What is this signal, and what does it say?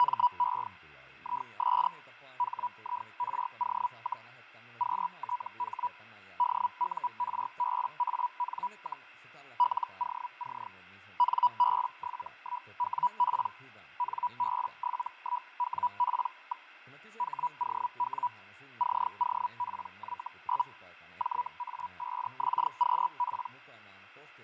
Hellschreiber (Feld-Hell, 122.5 baud), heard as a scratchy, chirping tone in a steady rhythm, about 980 Hz, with fading and speech in Finnish. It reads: … IS HIRO, QTH DURBAN, LOC NB71WP NB71WP. HOW COPY? JA5XQP